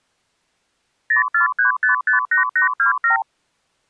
Multi-frequency trunk signalling (R2, with the far end's replies), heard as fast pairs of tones, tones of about 120 ms. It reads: 043558827